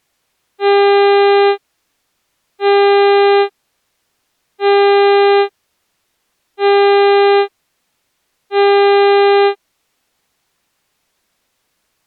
Ship horn signal, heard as a ship's horn, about 400 Hz. 5 short. At sea: I doubt that you are doing enough to avoid a collision.